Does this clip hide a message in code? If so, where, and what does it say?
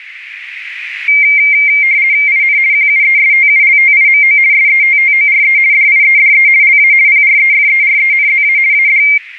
Yes: RTTY (50 baud, 170 Hz shift) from 1.1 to 9.2 s, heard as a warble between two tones, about 2200 Hz centre, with radio static. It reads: IN QUESTULTIMO SETTORE DIEDE LA PREFERENZA AD